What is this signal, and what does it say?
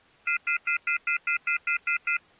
Telephone call progress tone (North American plan), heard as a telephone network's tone, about 1400, 2050, 2450, 2600 Hz, 0.1 s on and 0.1 s off. Off-hook warning tone.